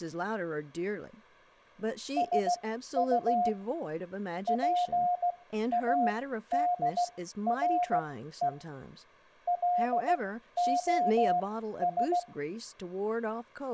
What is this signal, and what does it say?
Morse code, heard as a keyed tone, machine-sent, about 16 wpm, spaced as for 12 wpm, 710 Hz, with room echo and speech in English. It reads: SU PADRE LOS